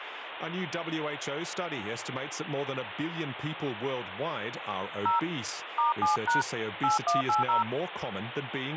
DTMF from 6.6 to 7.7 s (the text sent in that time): 8180